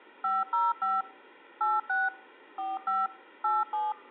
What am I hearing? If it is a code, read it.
DTMF, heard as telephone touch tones, dialled by machine, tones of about 190 ms. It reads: 505 86 45 87